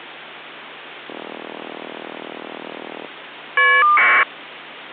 Caller ID data burst, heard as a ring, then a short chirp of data, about 1200 baud.